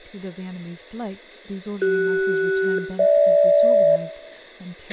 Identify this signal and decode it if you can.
Aircraft SELCAL, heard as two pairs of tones, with a squelch burst at the end, room echo and speech in English. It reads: CS-GH